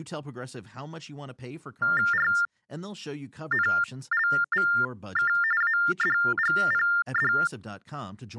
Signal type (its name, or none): TTY/TDD text telephone tones